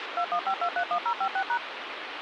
DTMF, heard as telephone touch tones, dialled by machine, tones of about 80 ms, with phone line noise. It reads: 215231056#